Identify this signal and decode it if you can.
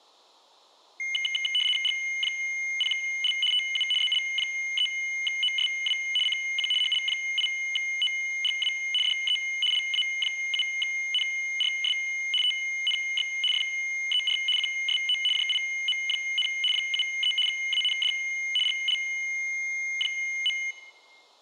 RTTY (75 baud, 850 Hz shift), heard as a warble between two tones, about 2550 Hz centre. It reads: G0L TU ZL3OSW CQ HL8OGW DE LA7NRS TNX FER QSO JIM, 73 AND GL.